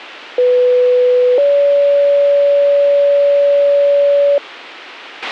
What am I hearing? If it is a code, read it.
Two-tone page, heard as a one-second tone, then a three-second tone, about 500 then 570 Hz, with a squelch burst at the end.